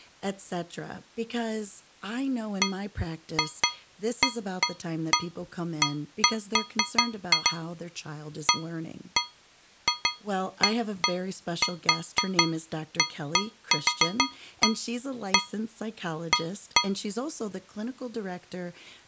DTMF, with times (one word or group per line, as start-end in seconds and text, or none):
none